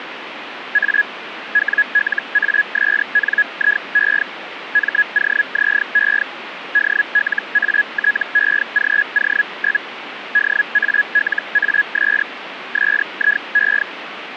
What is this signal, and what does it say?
Hellschreiber (Feld-Hell, 122.5 baud), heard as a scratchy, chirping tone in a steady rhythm, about 1700 Hz, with radio static. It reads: A WLASNIE MOZE DLATEGO? DALAS SIE